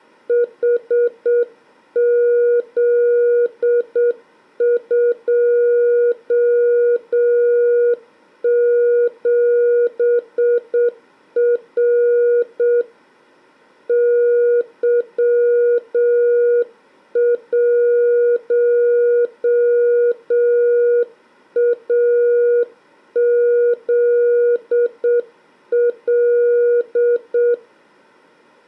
Morse code, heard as a keyed tone, hand-sent with a straight key, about 7 wpm, 480 Hz. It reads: HZ27R Y1AZL